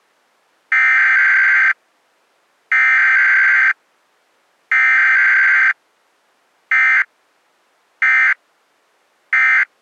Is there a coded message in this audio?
Yes: Emergency Alert System (SAME) tones (header bursts, then end-of-message bursts) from 0.7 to 9.6 s, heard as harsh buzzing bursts, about 520.83 baud.